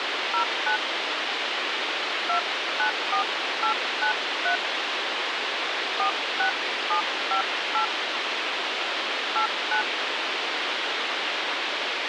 DTMF, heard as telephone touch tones, dialled by hand, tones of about 100 ms, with radio hiss. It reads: 09 294893 46758 89